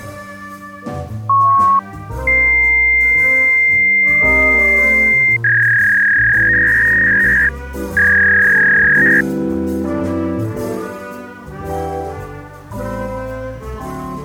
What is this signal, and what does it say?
Fax machine handshake, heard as a beep, a long tone and a warble.